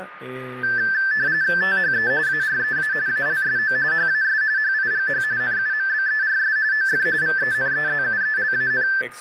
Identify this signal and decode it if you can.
RTTY (45.45 baud, 170 Hz shift), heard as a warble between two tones, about 1650 Hz centre, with radio static, a steady whistle near 1220 Hz and speech in Spanish. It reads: THE AREA ALSO HAS HIGH NUMBERS OF VENEZUELAN